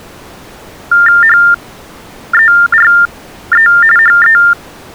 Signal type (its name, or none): TTY/TDD text telephone tones